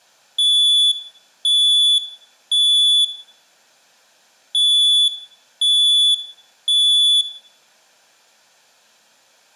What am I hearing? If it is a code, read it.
Alarm pattern, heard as an alarm's beeps, played twice, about 3450 Hz, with room echo. Temporal three. Smoke or fire, evacuate.